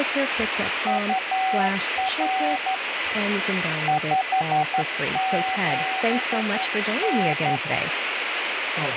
Morse code, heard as a keyed tone, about 11 wpm, 760 Hz, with radio static, a weaker station near 2010 Hz and speech in English. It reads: UR 57N